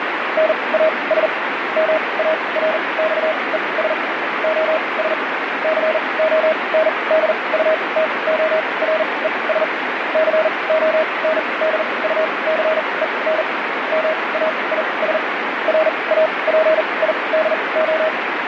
Morse code, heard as a keyed tone, machine-sent, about 40 wpm, spaced as for 26 wpm, 630 Hz, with radio static. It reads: NAS MARXES OS CONDUTORES CONDUCEN MAIS RAPIDO